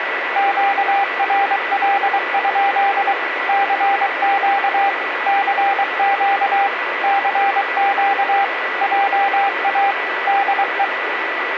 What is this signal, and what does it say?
Morse code, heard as a keyed tone, machine-sent, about 23 wpm, 800 Hz, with radio static and a steady whistle near 1970 Hz. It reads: QRL? CQ CQ CQ JA DE